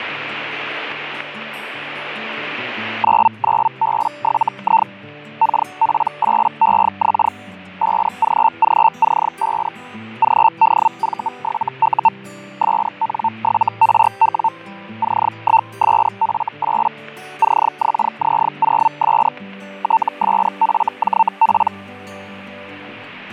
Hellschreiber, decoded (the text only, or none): 99B7I KP8EX 5GGC5 GDV7U SN7RW C1SF8 CXZ0S TSFJP